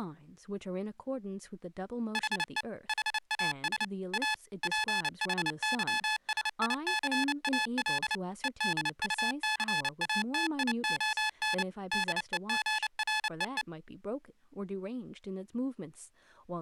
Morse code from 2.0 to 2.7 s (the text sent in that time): HE